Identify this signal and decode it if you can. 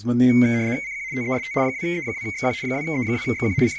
RTTY (75 baud, 170 Hz shift), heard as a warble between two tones, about 2150 Hz centre, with speech in Hebrew. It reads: CQ TEST 2E2XQ 2E2XQ …